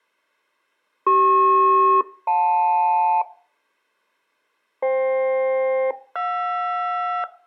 Aircraft SELCAL, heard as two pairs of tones. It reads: CP-JL FK-JR